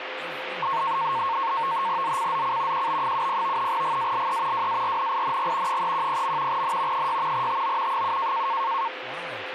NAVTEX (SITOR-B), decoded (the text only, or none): ZCZC QB70 GALE WARNING 310. N 6 TO 7